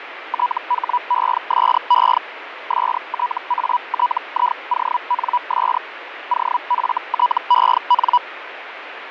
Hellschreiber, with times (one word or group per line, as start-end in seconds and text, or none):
0.3-2.2 THESE
2.7-5.8 STATIONS
6.3-8.2 OFTEN